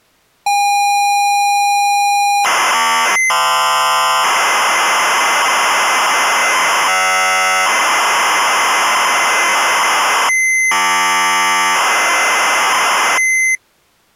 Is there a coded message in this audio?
Yes: ZX Spectrum tape loading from 0.5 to 13.6 s, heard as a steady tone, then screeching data.